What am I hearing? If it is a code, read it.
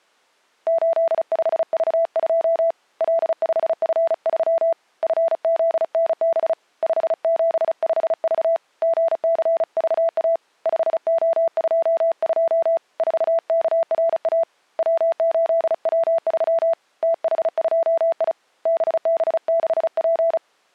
Morse code, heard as a keyed tone, hand-sent with a paddle, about 35 wpm, 660 Hz. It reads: 85V2 L5F3 FZNB 575V GCVA 5O22 4KRA W8W3 TH2I BB6P